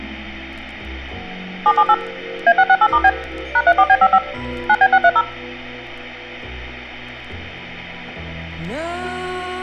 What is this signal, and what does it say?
DTMF, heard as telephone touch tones, dialled by machine, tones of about 60 ms, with room echo. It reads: 778 A668*B #34B55 9B630